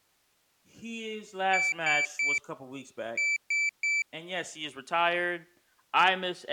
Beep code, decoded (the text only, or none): 3-3